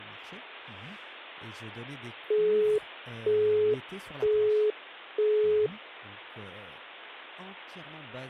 Telephone call progress tone (single-tone plan, as in Europe, Japan and elsewhere), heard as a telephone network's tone, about 420 Hz, 0.48 s on and 0.48 s off, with speech in French. Busy tone.